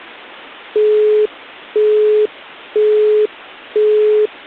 Telephone call progress tone (single-tone plan, as in Europe, Japan and elsewhere), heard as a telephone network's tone, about 420 Hz, 0.5 s on and 0.5 s off. Busy tone.